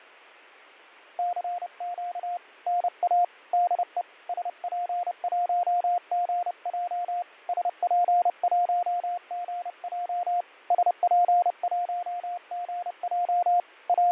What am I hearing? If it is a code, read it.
Morse code, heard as a keyed tone, hand-sent with a paddle, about 30 wpm, 710 Hz, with fading. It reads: CQ NA DE SP1GJ SP1GJ SP1GJ …